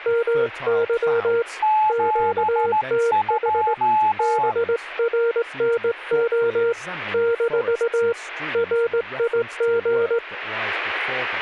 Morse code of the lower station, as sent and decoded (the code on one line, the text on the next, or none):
-- -.-- / --.- - .... / -... .-. -. --- / -....- / .-. .. --.
MY QTH BRNO - RIG